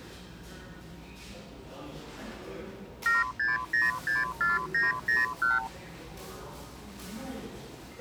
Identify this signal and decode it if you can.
Multi-frequency trunk signalling (R2, with the far end's replies), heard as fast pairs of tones, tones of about 170 ms, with the noise of a cafe. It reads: 76064901